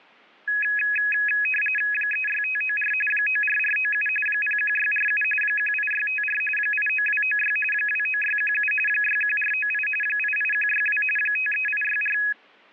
RTTY (45.45 baud, 850 Hz shift), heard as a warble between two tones, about 2100 Hz centre. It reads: 36594 94497 01647 18654 89296 29617 61498 88162 53864